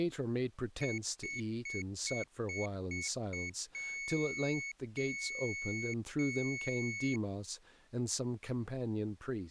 Beep code, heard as a piezo beeper, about 2200 Hz, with speech in English. 7 short, 3 long.